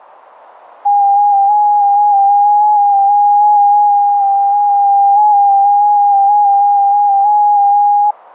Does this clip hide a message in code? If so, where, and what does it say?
Yes: FT8 (one signal) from 0.8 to 8.1 s, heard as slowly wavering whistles, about 6.25 baud.